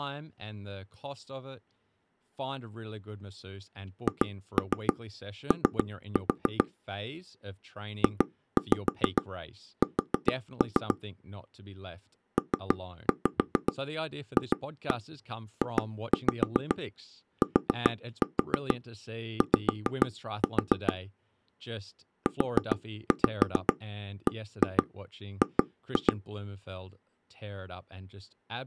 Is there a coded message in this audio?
Yes: tap code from 4.1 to 26.1 s, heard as taps on a table, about 6 knocks a second, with speech in English. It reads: HO JS PFJTY UBG